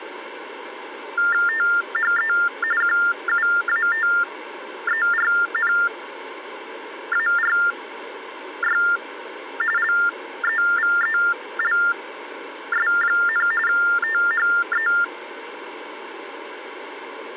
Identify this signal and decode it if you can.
TTY/TDD text telephone tones (45.45 baud Baudot), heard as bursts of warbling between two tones, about 400 Hz shift, 1600 Hz centre. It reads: THE QUATERNARY LEVELS, THE